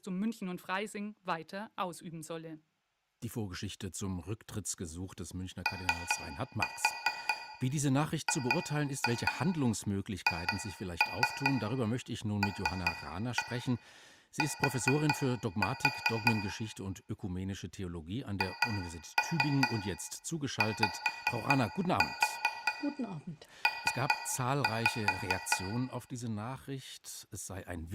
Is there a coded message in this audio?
Yes: tap code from 5.7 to 25.7 s, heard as taps on a metal pipe, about 4 knocks a second, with room echo and speech in German. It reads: OGHLT HYP